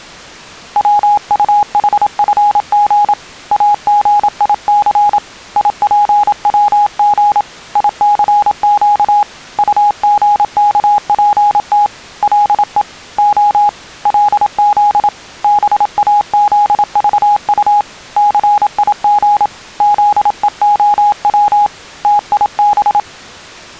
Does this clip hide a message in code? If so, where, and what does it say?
Yes: Morse code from 0.7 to 23.1 s, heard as a keyed tone, hand-sent with a paddle, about 27 wpm, 830 Hz. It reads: WUHFG AGIC IPWG ICQ UGKPT LE O LZ BAZVU CIG ZEOW TIB